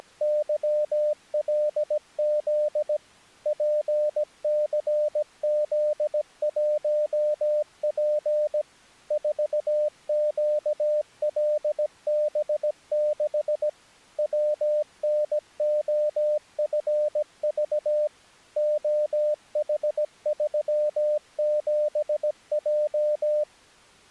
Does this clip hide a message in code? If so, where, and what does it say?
Yes: Morse code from 0.0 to 23.5 s, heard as a keyed tone, machine-sent, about 17 wpm, 600 Hz. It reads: … PCZ1P 4QLB6 WNOFV OH37J